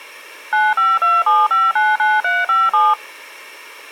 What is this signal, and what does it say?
DTMF, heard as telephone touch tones, dialled by machine, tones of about 200 ms. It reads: 9527599357